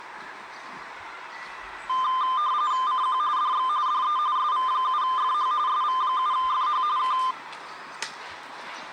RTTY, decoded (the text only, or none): CQ DX DE SV7FH SV7FH K